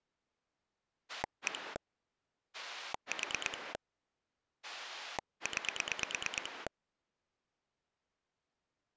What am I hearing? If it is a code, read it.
Pulse dialling, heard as a rotary dial, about 9 pulses a second. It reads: 1 4 9